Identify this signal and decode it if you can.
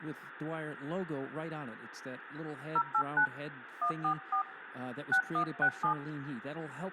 DTMF, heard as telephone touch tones, dialled by hand, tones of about 90 ms, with phone line noise and speech in English. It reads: 089 144 6167